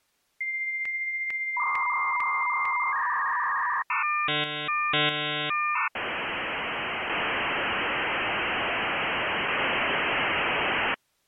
Dial-up modem handshake (V.34 or later), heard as a whistle, warbles, then hiss.